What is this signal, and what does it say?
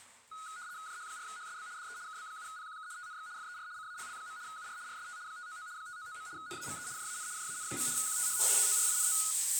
RTTY (75 baud, 170 Hz shift), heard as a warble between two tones, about 1360 Hz centre, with the noise of a restroom. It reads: JH4HSB DE KB7PQK TNX FER CALL. UR RST 599 599. NAME JAN JAN. QTH TORINO